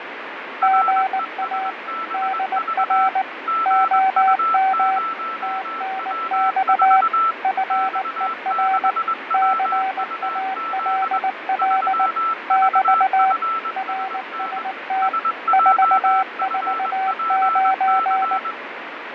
Morse code, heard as two keyed tones, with radio static and fading. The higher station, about 21 wpm, 1330 Hz: RESBV GU0W4 X6WUZ 3VFSN SJFPC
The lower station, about 19 wpm, 760 Hz: GA DR OM TNX FER CALL <BT> RST 449